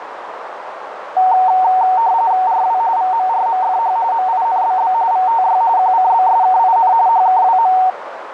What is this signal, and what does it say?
RTTY (45.45 baud, 170 Hz shift), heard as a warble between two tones, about 830 Hz centre, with radio static and a narrow filter. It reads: RW VMRMFH MINBB VTY QCBSKIN HKWM